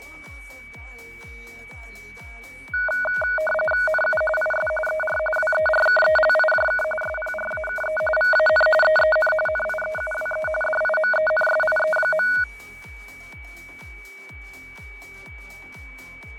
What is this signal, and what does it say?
RTTY (45.45 baud, 850 Hz shift), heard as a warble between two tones, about 1050 Hz centre, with fading and a steady whistle near 2280 Hz. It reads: NU IS ER WERKELIJK SPRAKE VAN EEN NIEUWE DIMENSIE.